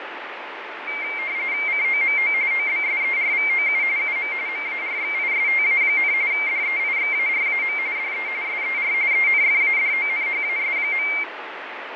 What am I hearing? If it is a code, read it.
RTTY (45.45 baud, 170 Hz shift), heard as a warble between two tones, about 2200 Hz centre, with radio static and fading. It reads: COMO OBSERVOU UM MARXISTA, DEIXARAM DE SER ENFADONHAS.